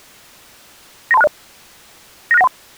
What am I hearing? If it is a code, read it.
Five-tone selective call (EIA), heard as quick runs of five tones, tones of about 30 ms. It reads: 93260 96913